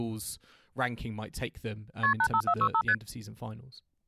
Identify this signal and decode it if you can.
Multi-frequency trunk signalling (R1, as on North American trunks), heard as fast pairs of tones, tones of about 70 ms, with speech in English. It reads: KP 85465 ST